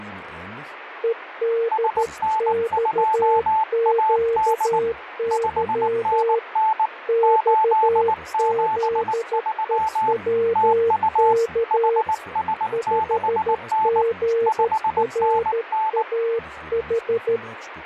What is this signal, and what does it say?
Morse code, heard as two keyed tones, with radio static. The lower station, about 13 wpm, 460 Hz: EDXQY XZEWK 5GRAH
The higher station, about 19 wpm, 880 Hz: SN2AD 5NN 873 TU HS6N 5NN